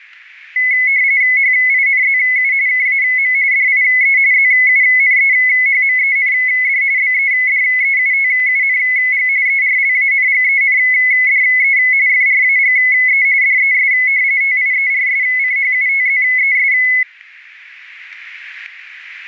RTTY (45.45 baud, 170 Hz shift), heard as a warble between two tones, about 2100 Hz centre, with static crashes. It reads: HINZU KAM DIE ZUNEHMEND BEDEUTUNG ERLANGENDE FRAGE DES TIERSCHUTZES